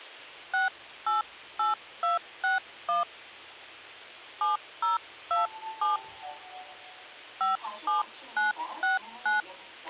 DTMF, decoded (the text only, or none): 688261 7027 57969